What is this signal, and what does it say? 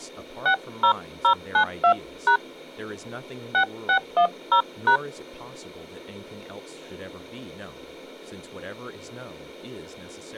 DTMF, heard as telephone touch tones, dialled by hand, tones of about 90 ms, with speech in English. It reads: 60092# 6610#